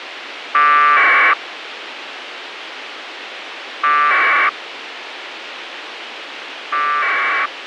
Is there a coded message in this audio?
Yes: packet radio (AX.25, as in APRS), 1200 baud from 0.5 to 7.5 s, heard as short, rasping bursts, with radio hiss and a squelch burst at the end.